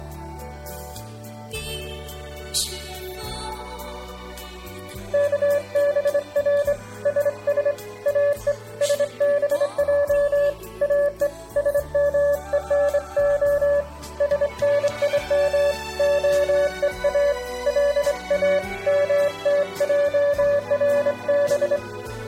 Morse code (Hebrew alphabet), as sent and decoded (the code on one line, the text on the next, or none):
-.- -... .-. / ... ... / .- . / ... -... .--- / .- . / ... -- . -. --- / ... -. .. -- / --- . .- / .-.. .- / -- - .--- .-. -...
כבר שש או שבע או שמונה שנים הוא לא מתערב